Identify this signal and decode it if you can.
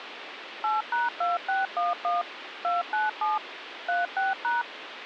DTMF, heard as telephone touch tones, dialled by machine, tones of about 170 ms, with phone line noise. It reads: 8#2611 297 36#